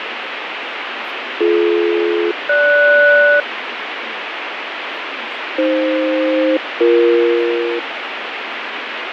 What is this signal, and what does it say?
Aircraft SELCAL, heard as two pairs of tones, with radio static, fading and speech in Tamil. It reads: BD-GS AF-BE